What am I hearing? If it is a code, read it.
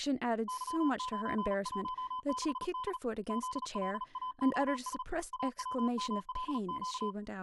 Morse code, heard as a keyed tone, hand-sent with a paddle, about 37 wpm, 1020 Hz, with speech in English. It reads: Y916D ZLAXS AWMLQ